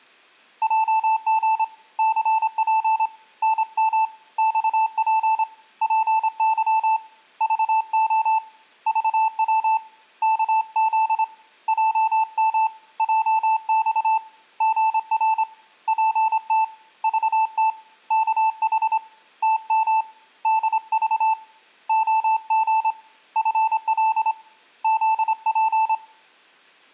Morse code, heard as a keyed tone, hand-sent with a straight key, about 26 wpm, 880 Hz, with room echo. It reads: JG CP NM XP PY VO VW KZ JM JX GR PT VT KH TM DV OG FL ZP